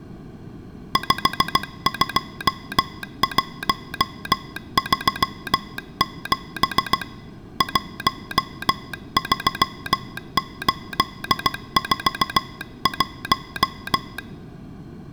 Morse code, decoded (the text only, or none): 52137 13841